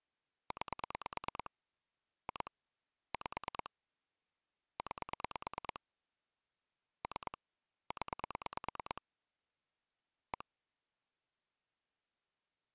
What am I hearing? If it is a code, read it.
Pulse dialling, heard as clicks on a phone line, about 9 pulses a second. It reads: 9 2 5 9 3 0 1